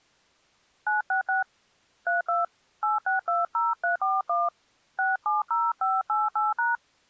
DTMF, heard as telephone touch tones, dialled by hand, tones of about 160 ms. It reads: 966 32 8620341 670588#